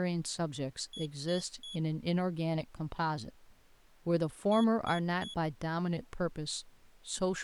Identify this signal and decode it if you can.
Beep code, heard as a piezo beeper, played twice, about 3350 Hz, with speech in English. 3 short. In AMI BIOS tables: failure in the first 64 KB of memory; in Dell tables: chipset error.